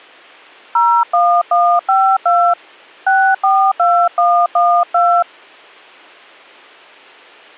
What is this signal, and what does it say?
DTMF, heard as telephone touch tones, dialled by hand, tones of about 280 ms. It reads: 01152 642112